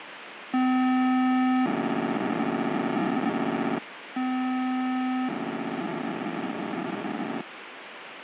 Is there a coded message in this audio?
Yes: POCSAG pager data (512 baud) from 0.5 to 7.4 s, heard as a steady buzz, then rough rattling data, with radio hiss.